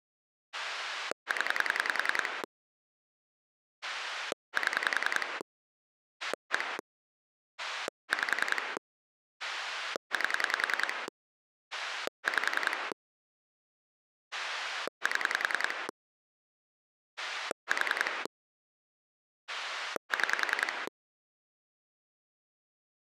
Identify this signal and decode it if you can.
Pulse dialling, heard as a rotary dial, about 10 pulses a second. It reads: 0 7 1 5 8 5 7 4 6